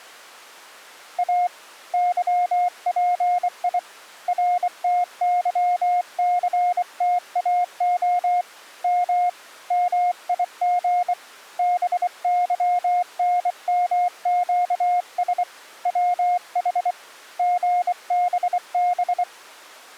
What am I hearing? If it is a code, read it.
Morse code, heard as a keyed tone, hand-sent with a bug key, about 24 wpm, 710 Hz. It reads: A YPI RTYCTAO M MIG BYNMQS WH GBB